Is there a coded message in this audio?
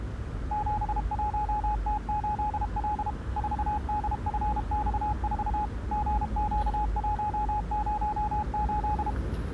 Yes: Morse code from 0.5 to 9.2 s, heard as a keyed tone, machine-sent, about 32 wpm, 840 Hz, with street noise. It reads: 71T8L 4DFX4 GQ108